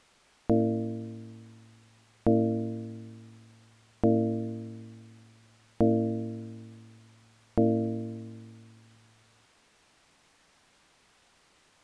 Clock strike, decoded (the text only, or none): 5